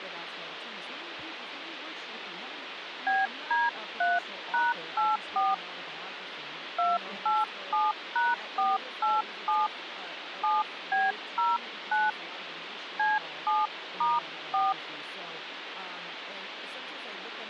DTMF, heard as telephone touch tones, dialled by hand, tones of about 190 ms, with phone line noise and speech in English. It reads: BD3#84 287#487 7B09 C7*4